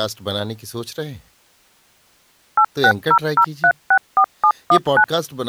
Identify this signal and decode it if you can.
DTMF, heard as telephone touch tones, dialled by machine, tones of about 70 ms, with speech in Urdu. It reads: 8600364719